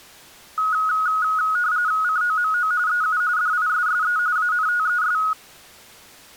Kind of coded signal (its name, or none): RTTY